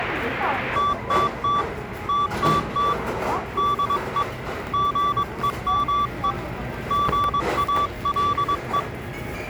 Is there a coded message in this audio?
Yes: Morse code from 0.7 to 8.9 s, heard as a keyed tone, hand-sent with a paddle, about 22 wpm, 1160 Hz, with the noise of a crowd indoors. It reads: TTT TTT DE GEME GALE